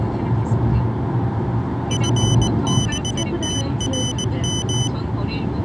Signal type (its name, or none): Morse code